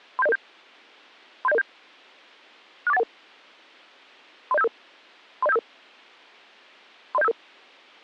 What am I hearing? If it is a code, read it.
Five-tone selective call (EIA), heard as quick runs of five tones, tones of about 30 ms. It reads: 37007 37007 64811 30755 30755 30755